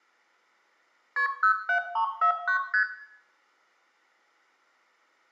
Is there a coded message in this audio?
Yes: multi-frequency trunk signalling (R1, as on North American trunks) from 1.2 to 2.8 s, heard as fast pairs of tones, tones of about 100 ms, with room echo. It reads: KP 07349 ST